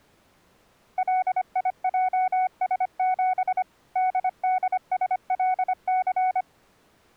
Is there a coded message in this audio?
Yes: Morse code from 0.9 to 6.5 s, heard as a keyed tone, machine-sent, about 25 wpm, 740 Hz. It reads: LIJS7 DDSLC